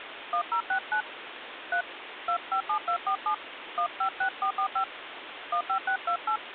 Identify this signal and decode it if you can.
DTMF, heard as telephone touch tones, dialled by hand, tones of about 90 ms, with phone line noise. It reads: 1069 3 257247 156445 15628